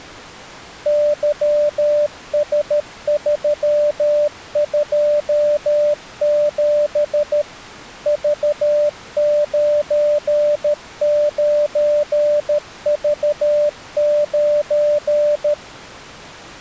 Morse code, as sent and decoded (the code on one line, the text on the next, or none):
-.-- ... ...-- ..--- --... / ...- ----. ----. ...- ----.
YS327 V99V9